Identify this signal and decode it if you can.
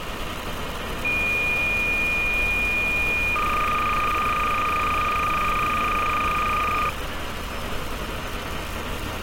Cassette data (Kansas City type), 300 baud, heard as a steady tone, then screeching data, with street noise.